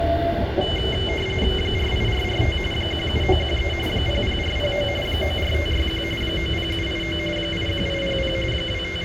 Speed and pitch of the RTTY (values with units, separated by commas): 45.45 baud, 850 Hz shift, 2550 Hz centre